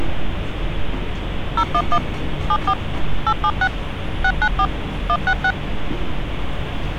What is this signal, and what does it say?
DTMF, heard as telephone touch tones, dialled by machine, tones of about 60 ms, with street noise. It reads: 011 74 876 694 166